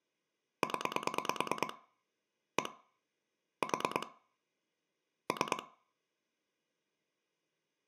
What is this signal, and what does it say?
Pulse dialling, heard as clicks on a phone line, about 9 pulses a second, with room echo. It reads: 0 1 4 3